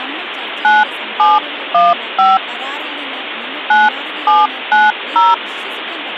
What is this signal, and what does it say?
DTMF, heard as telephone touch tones, dialled by hand, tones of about 190 ms, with phone line noise and speech in Malayalam. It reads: 9715 9790